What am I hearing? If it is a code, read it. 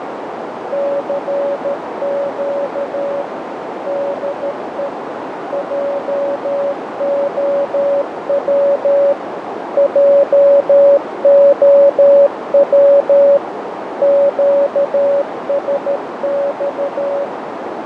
Morse code, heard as a keyed tone, machine-sent, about 13 wpm, 560 Hz, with heavy radio static, fading and a narrow filter. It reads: CQ DE JOW JOW QSX